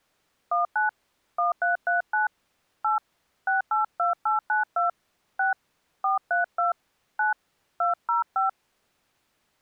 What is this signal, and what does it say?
DTMF, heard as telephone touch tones, dialled by hand, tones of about 140 ms. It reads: 19 1339 8 682892 6 432 9 205